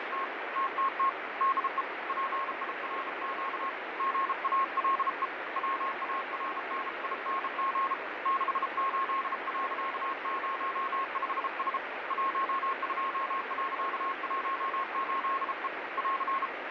Morse code, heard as a keyed tone, hand-sent with a bug key, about 33 wpm, 1080 Hz, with heavy radio static and fading. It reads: … TTT DE PIRQ GALE WARNING 68.05S 12.18E <AR>